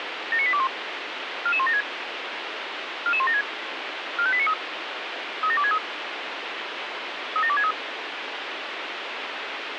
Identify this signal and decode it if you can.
Five-tone selective call (ZVEI), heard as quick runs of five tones, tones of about 70 ms, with radio hiss. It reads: 79821 44176 44176 45893 37263 37263